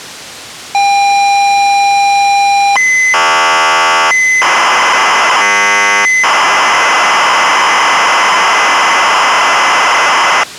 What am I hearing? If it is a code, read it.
ZX Spectrum tape loading, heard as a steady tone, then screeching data.